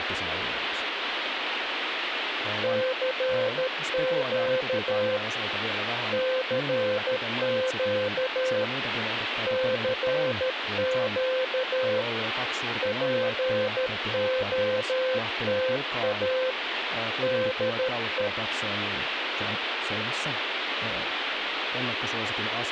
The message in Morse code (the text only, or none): CQ CQ CQ POTA DE